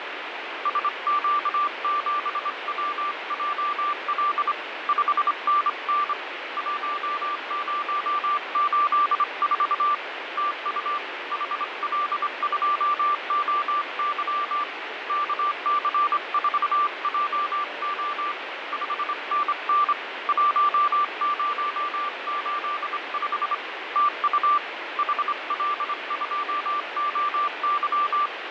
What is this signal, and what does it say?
Morse code, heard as a keyed tone, hand-sent with a straight key, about 25 wpm, 1180 Hz, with radio static and fading. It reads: SQ7WJL 5NN 1084 TU HL2OY KC4JO 5NN 1085 TU HL2OY